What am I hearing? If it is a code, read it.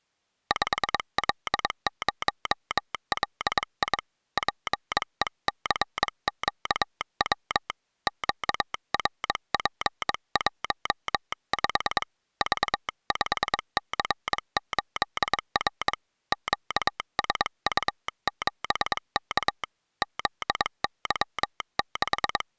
Morse code, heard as a telegraph sounder, hand-sent with a bug key, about 22 wpm. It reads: 5L0LI PECQW QRP15 V5C8R QSU7K …